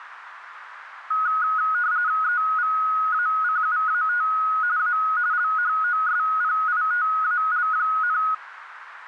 RTTY (45.45 baud, 170 Hz shift), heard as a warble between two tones, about 1360 Hz centre, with radio static. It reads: EVACUAT A LHOSPITAL,